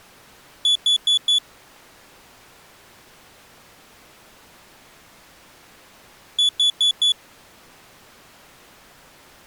Alarm pattern, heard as an alarm's beeps, played twice, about 3450 Hz. Temporal four. Carbon monoxide.